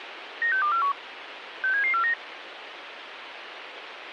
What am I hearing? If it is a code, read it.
Five-tone selective call (CCIR), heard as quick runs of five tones, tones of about 100 ms, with radio hiss. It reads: 96241 67749